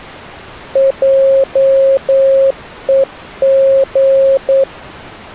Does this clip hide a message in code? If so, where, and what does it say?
Yes: Morse code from 0.7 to 4.7 s, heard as a keyed tone, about 9 wpm, 540 Hz. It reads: JEG